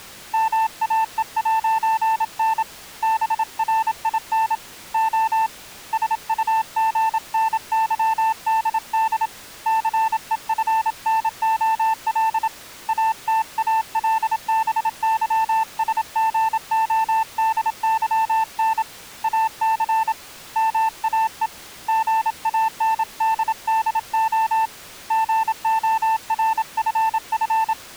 Morse code, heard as a keyed tone, hand-sent with a paddle, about 27 wpm, 890 Hz. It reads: MAE'N BRIN O SUGNYDD CEFNOL ATALBYSGODYN AC MAE GANDDO GORFF